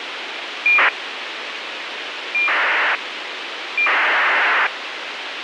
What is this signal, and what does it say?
ACARS aircraft data, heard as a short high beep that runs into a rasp, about 2400 baud, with radio hiss.